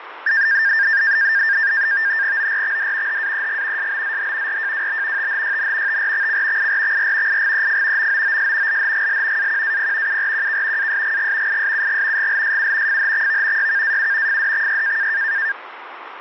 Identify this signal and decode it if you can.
NAVTEX (SITOR-B), 100 baud, 170 Hz shift, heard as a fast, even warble, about 1700 Hz centre, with radio static and fading. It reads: ORXD HAEG SBZH RJWB THYN TRXC IRXR IGEF MOOS LHGL AQAP URQK ASGG ISUG GLSU FHXV YKAU FDXY